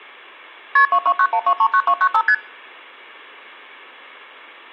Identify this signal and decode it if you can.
Multi-frequency trunk signalling (R1, as on North American trunks), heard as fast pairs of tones, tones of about 70 ms. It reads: KP 2291239295 ST